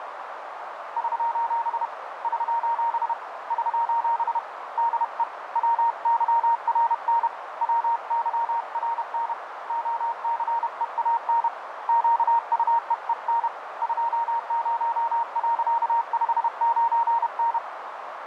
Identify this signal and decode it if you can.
Morse code, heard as a keyed tone, hand-sent with a paddle, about 31 wpm, 930 Hz, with radio static and a narrow filter. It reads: <SOS> <SOS> <SOS> DE WYRN WYRN OCEAN QUEEN 20.59N